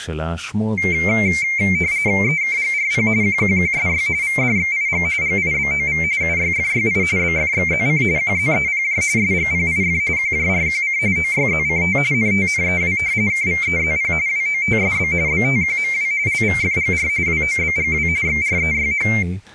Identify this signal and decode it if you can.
RTTY (45.45 baud, 170 Hz shift), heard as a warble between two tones, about 2200 Hz centre, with speech in Hebrew. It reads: EKGRP QQQSY VDXIG GIBOV UYFYI BFXZC QZEPJ SGPIF QJRQC OYZCT NTNEW KVEZP WOTSB BTQMW LVFGR WOBGW XREYH